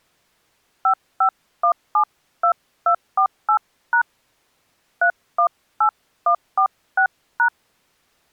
DTMF, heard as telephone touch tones, dialled by hand, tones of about 90 ms. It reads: 55172248# 318146#